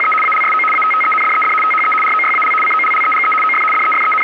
RTTY (75 baud, 850 Hz shift), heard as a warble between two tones, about 1700 Hz centre, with radio static. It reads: … ALSO ATTENDED THE ROYAL COLLEGE OF …